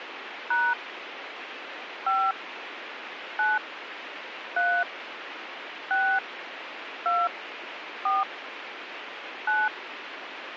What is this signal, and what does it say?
DTMF, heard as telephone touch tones, dialled by hand, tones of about 200 ms, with radio hiss. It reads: # 5 9 3 6 2 4 9